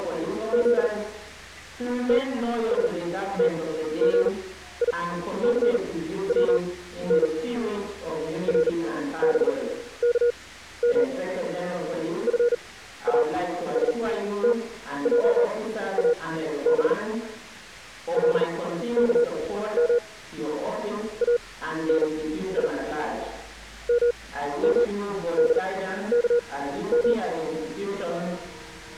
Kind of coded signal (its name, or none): Morse code